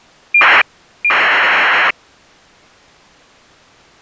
ACARS aircraft data, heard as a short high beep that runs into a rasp, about 2400 baud.